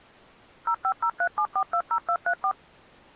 DTMF, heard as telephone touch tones, dialled by machine, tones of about 70 ms. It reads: 05037420234